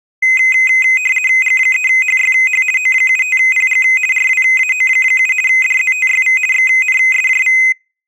RTTY (50 baud, 450 Hz shift), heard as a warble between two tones, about 2300 Hz centre. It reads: G3HYH O75PG RWAO7 DZTYV XNSJV